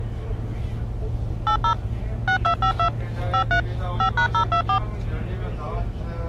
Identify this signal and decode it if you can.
DTMF, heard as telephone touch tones, dialled by machine, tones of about 90 ms, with the noise inside a bus. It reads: 80 6252 53 5#024